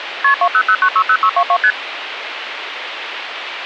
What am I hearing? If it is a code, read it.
Multi-frequency trunk signalling (R1, as on North American trunks), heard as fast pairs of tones, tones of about 70 ms, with phone line noise. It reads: KP 200960622 ST